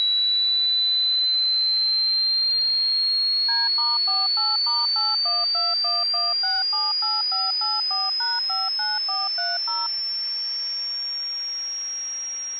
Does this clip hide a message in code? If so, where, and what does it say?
Yes: DTMF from 3.5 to 9.9 s, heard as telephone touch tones, dialled by machine, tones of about 190 ms. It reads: D*48*81211678584#59430